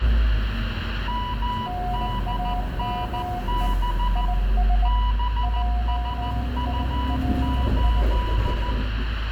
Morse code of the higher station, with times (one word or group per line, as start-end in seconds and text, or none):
1.1-4.2 MDNB
4.8-8.7 BSU8